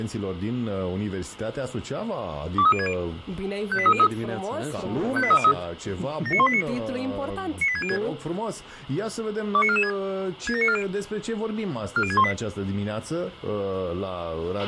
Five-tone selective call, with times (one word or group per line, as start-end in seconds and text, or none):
2.6-2.9 23060
3.7-4.1 58303
5.2-5.5 58303
6.3-6.6 79189
7.6-8.0 98606
9.5-9.9 29446
10.5-10.8 67940
12.0-12.3 40618